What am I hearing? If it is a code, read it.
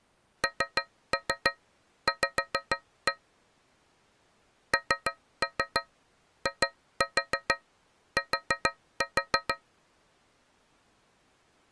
Tap code, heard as taps on a metal pipe, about 6 knocks a second. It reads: NV NIT